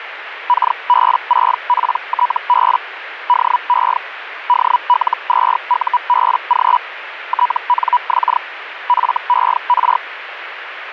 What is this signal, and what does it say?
Hellschreiber (Feld-Hell, 122.5 baud), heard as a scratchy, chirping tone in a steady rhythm, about 980 Hz, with radio static. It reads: KB6PTB DE DL2UBG TNX FER